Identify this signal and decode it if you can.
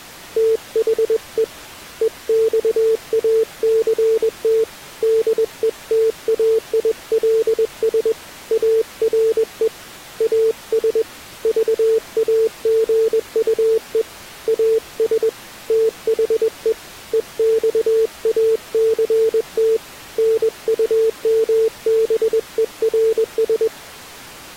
Morse code, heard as a keyed tone, hand-sent with a paddle, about 21 wpm, 450 Hz. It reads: THE EXACT DETAILS ARE AS VAGUE AS THE EXACT NUMBERS